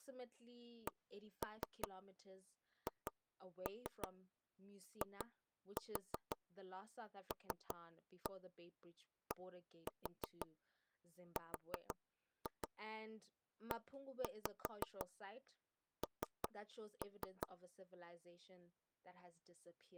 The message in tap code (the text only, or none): CHILDREN